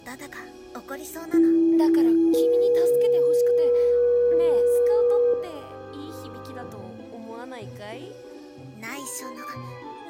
Two-tone page, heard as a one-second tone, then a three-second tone, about 330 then 480 Hz, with room echo.